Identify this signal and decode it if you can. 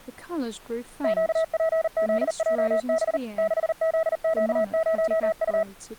Morse code, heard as a keyed tone, machine-sent, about 39 wpm, 650 Hz, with speech in English. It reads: QPZJB 6ZQ0U